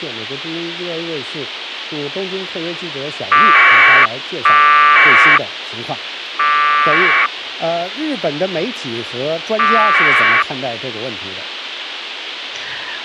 Packet radio (AX.25, as in APRS), 1200 baud, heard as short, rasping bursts, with radio hiss and a squelch burst at the end.